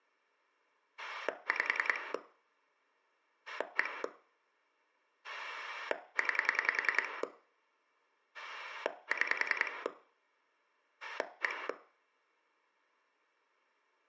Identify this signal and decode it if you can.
Pulse dialling, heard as a rotary dial, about 10 pulses a second, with room echo. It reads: 5 1 9 6 1